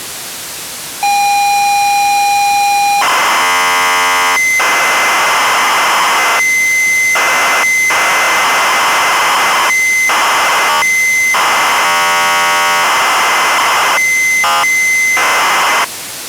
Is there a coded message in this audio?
Yes: ZX Spectrum tape loading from 1.0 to 15.8 s, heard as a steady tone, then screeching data, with tape hiss.